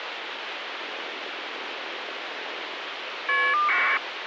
Caller ID data burst, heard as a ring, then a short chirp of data, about 1200 baud, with phone line noise.